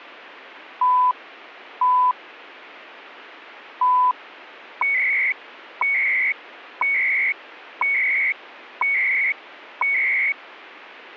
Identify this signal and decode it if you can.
Radio time signal (CHU, Canada), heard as beeps and data bursts, one a second.